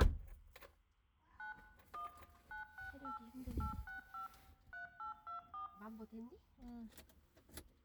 DTMF, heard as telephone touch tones, dialled by machine, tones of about 120 ms, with room echo and the noise inside a car. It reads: 9 1 968 865 3824